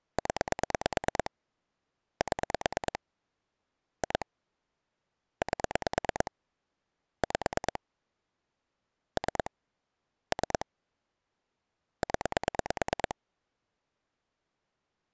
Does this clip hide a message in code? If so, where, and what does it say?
Yes: pulse dialling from 0.2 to 13.1 s, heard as clicks on a phone line, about 9 pulses a second. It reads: 0 7 2 8 5 3 3 0